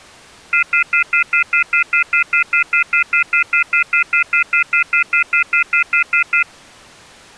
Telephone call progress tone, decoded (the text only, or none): off-hook warning tone